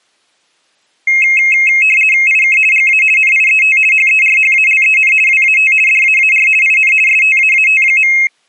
RTTY (50 baud, 450 Hz shift), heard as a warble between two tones, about 2350 Hz centre. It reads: IK GA NIET HERHALEN WAT DAAR IN STAAT.